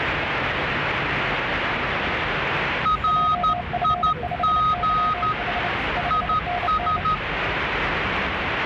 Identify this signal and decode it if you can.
Morse code, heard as two keyed tones, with radio static and the noise inside a subway train. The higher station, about 13 wpm, 1250 Hz: RIG IS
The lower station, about 29 wpm, 710 Hz: JF5YH 5NN